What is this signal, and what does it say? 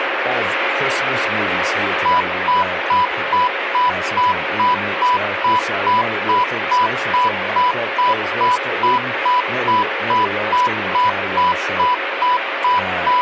Evenly repeated beeps, with radio static and speech in English. There is no code.